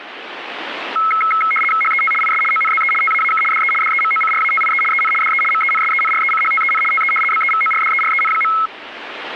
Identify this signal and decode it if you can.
RTTY (75 baud, 850 Hz shift), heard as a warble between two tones, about 1750 Hz centre, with radio static. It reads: HET IS ONZE TAAK DE DEMOCRATIE EN DE MENSENRECHTEN TE BEVORDEREN.